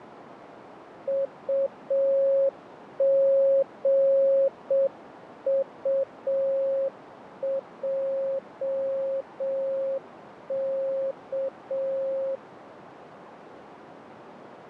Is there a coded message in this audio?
Yes: Morse code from 1.0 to 12.4 s, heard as a keyed tone, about 6 wpm, 540 Hz, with radio static, fading and a narrow filter. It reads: UGUJK